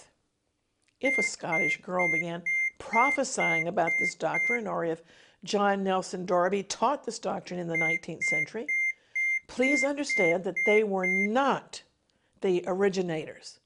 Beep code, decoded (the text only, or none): 8 short